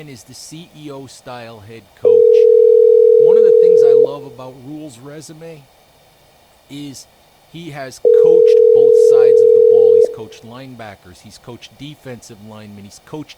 Telephone call progress tone (North American plan), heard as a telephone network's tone, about 440, 480 Hz, 2 s on and 4 s off, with room echo and speech in English. Ringback tone.